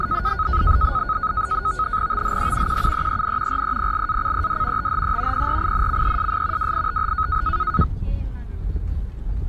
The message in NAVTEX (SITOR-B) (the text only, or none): THE QUEEN REPLACED THE PRINCESS WITH